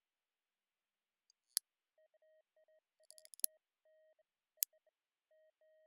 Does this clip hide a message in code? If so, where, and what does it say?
No, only beeps of irregular length.